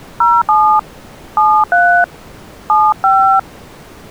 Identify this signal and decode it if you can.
DTMF, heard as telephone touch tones, dialled by hand, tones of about 260 ms. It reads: 07 73 75